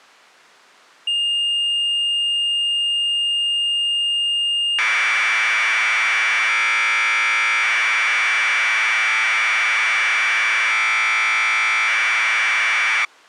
Commodore tape loading (standard loader), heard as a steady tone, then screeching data.